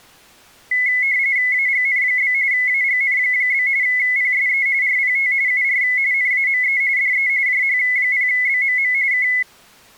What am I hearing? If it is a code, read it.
RTTY (45.45 baud, 170 Hz shift), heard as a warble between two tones, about 2100 Hz centre. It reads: AGN? AGN? PSE RPT UR NAME DE JH0BMM K